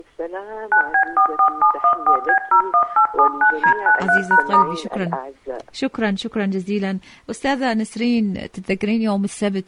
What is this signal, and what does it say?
DTMF, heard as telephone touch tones, dialled by machine, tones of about 90 ms, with room echo. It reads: 9B44714B01879D93#*